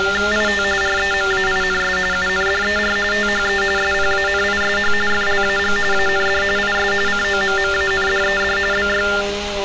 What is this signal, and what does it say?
TTY/TDD text telephone tones (45.45 baud Baudot), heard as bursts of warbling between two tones, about 400 Hz shift, 1600 Hz centre, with street noise. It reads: IT REMAINS UNDER THE SPANISH FLAG AND IS COMMANDED BY